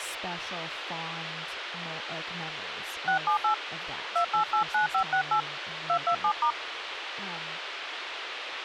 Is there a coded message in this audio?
Yes: DTMF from 3.1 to 6.5 s, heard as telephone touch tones, dialled by hand, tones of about 100 ms, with radio hiss and speech in English. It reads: 678 2889568 227*